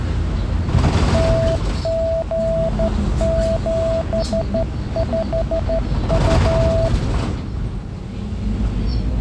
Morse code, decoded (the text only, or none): TG75U